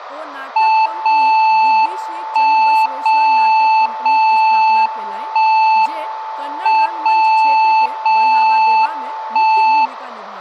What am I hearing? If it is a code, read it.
Radio time signal (WWVB), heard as a tone whose level steps once a second, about 880 Hz, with room echo and speech in Maithili. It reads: 0 1 0 0 1 M 0 0 1